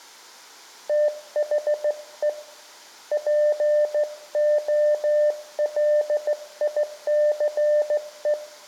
Morse code, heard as a keyed tone, hand-sent with a straight key, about 15 wpm, 600 Hz, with room echo. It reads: THE POLICE